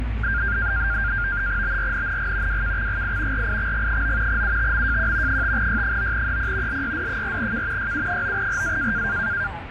NAVTEX (SITOR-B), 100 baud, 170 Hz shift, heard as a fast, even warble, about 1500 Hz centre, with radio static and the noise inside a bus. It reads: BRNNG WKXGI RIXG9 UTMJQ 5Y9EP LYD4K YU9RA